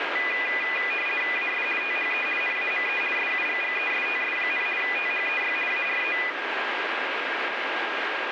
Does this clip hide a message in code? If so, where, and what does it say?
Yes: RTTY (50 baud, 450 Hz shift) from 0.2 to 6.3 s, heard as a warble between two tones, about 2200 Hz centre, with radio static and a steady whistle near 1620 Hz. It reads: AS THE NAME SUGGESTS, THEY ARE